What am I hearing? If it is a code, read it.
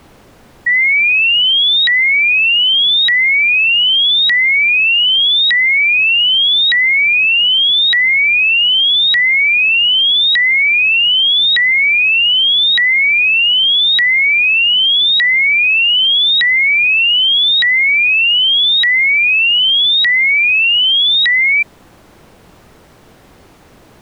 A tone that sweeps in pitch again and again. There is no code.